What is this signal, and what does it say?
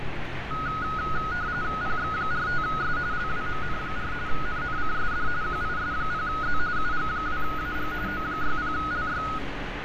RTTY (45.45 baud, 170 Hz shift), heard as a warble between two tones, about 1360 Hz centre, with radio static and street noise. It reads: PX45S LWMN4 NNCSD QIS0Z UG2AG O60LY